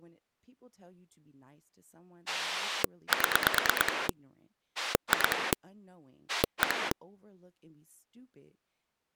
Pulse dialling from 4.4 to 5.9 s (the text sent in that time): 2